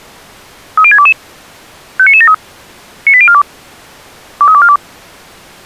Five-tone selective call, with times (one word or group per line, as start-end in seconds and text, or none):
0.8-1.1 30622
2.0-2.3 59973
3.1-3.4 98042
4.4-4.8 23242